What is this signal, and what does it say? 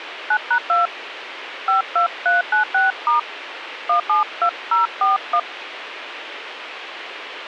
DTMF, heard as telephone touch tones, dialled by hand, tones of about 110 ms, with radio hiss. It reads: 9#2 52396* 172041